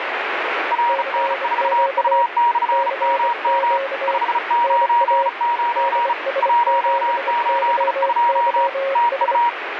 Morse code, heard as two keyed tones, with radio static. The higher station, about 35 wpm, 950 Hz: RN4U/MM 599 182 TU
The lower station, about 25 wpm, 540 Hz: CQ CQ NA DS7YYS